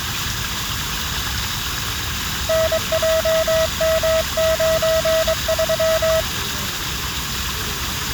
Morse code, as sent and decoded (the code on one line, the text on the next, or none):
-. .--- -- ----. ...--
NJM93